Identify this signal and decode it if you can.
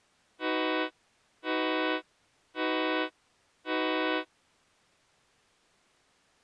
Train horn signal, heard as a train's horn. 4 short. On North American railways: a request for a signal to be given or repeated.